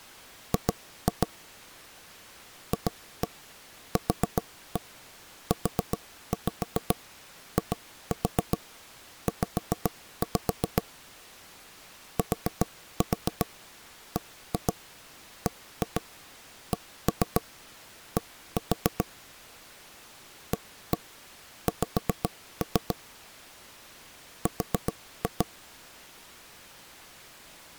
Tap code, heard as knocks on wood, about 7 knocks a second. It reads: G FQUIZ TBBCD AX R